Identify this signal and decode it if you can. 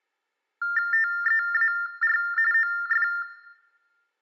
TTY/TDD text telephone tones (45.45 baud Baudot), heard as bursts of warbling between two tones, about 400 Hz shift, 1600 Hz centre, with room echo. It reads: TEAR OF